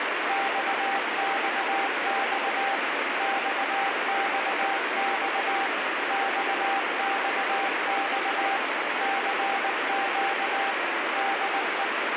Morse code, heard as a keyed tone, machine-sent, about 19 wpm, 790 Hz, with heavy radio static. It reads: XXX XXX XXX CQ DE